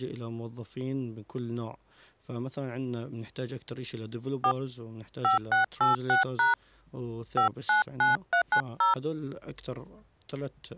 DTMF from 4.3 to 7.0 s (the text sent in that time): 4 5686#